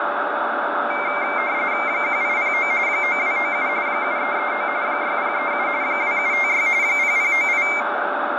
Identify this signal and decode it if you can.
RTTY (45.45 baud, 170 Hz shift), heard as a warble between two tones, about 2200 Hz centre, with radio static, fading, a steady whistle near 590 Hz and room echo. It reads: 1809 9297 7339 6037 2756 0098